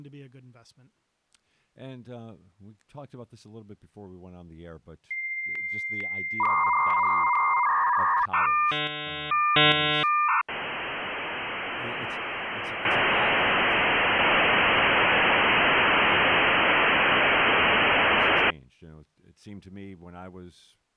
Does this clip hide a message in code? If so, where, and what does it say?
Yes: dial-up modem handshake (V.34 or later) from 5.1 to 18.5 s, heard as a whistle, warbles, then hiss, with speech in English.